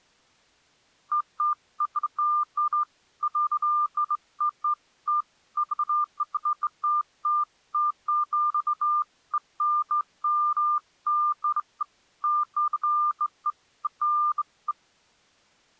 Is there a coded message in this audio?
No, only beeps of irregular length.